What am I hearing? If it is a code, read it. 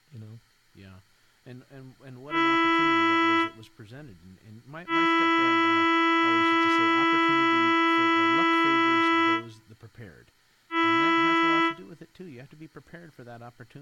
Ship horn signal, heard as a ship's horn, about 330 Hz, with room echo and speech in English. 1 short, 1 long, 1 short. At sea: a vessel at anchor warns of its position.